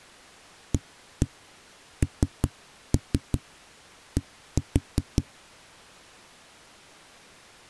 Tap code, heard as knocks on a wall, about 5 knocks a second. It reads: AND